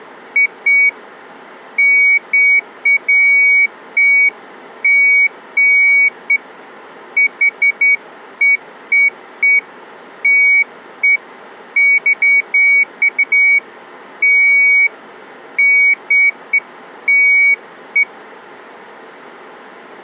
Beeps of irregular length. There is no code.